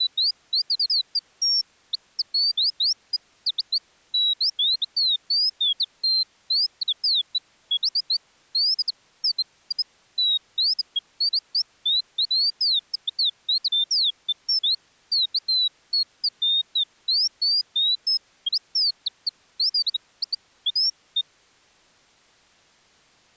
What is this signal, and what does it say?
Bird-like chirps. There is no code.